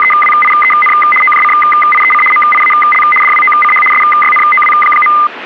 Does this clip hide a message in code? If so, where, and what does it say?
Yes: RTTY (75 baud, 850 Hz shift) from 0.0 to 5.3 s, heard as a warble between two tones, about 1650 Hz centre, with radio static. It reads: … OJCIEC MIAL DWOCH SYNOW.